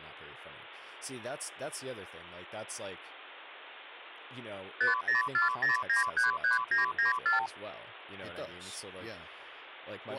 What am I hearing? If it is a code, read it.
Multi-frequency trunk signalling (R2, with the far end's replies), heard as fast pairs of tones, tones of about 140 ms, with speech in English. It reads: 5040933994